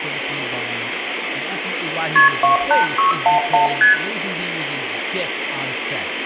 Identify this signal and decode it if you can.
Multi-frequency trunk signalling (R1, as on North American trunks), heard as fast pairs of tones, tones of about 130 ms, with phone line noise, room echo and speech in English. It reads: KP 28611 ST